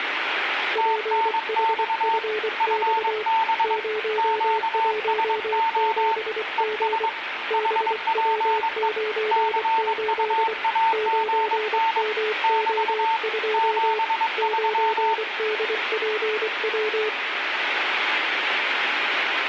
Morse code, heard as two keyed tones, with radio static and room echo. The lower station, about 24 wpm, 430 Hz: PHFX 017G BW98 9MO2 9DPW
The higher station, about 22 wpm, 900 Hz: TNX FB QSO ES HPE CUAGN <BT> 73